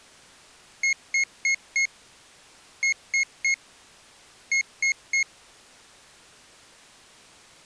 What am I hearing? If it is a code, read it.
Beep code, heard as a piezo beeper, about 2150 Hz. 4-3-3. In Phoenix BIOS tables: timer channel 2 failure.